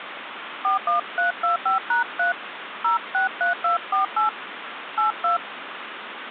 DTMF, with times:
0.6-2.3 41325#3
2.8-4.3 063248
5.0-5.4 82

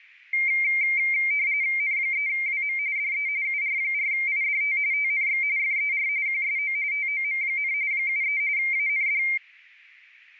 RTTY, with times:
1.8-2.8 N3WM
3.0-3.3 DE
3.4-4.8 UR4IDT
4.9-5.4 TNX
5.6-6.1 FER
6.3-6.8 QSO
6.9-7.7 TOM,
7.9-8.4 73
8.6-9.2 AND

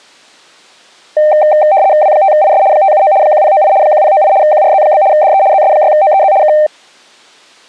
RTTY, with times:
2.0-2.6 W5IS
2.7-3.1 579
3.2-3.7 1098
3.8-4.3 1098
4.4-5.0 QRZ?
5.1-5.4 DE
5.5-6.3 ZS6OEZ
6.4-6.5 K

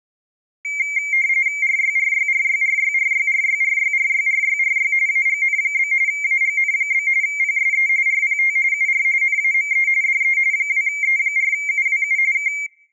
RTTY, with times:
1.6-4.9 RYRYRYRYRYRYRYRYRYRY
5.1-5.9 AGN?
6.1-7.1 AGN?
7.2-7.9 PSE
8.1-8.6 RPT
8.7-9.0 UR
9.2-9.9 NAME
10.0-10.4 DE
10.5-12.2 2E4UWU
12.3-12.5 K

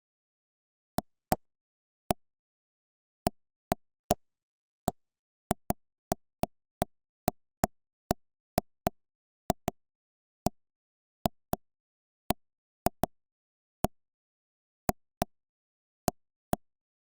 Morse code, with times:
none

